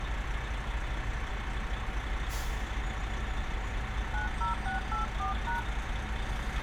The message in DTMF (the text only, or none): 90684#